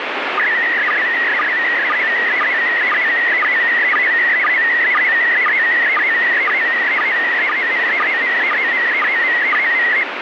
SSTV (slow-scan television), PD 120, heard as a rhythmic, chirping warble, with radio static.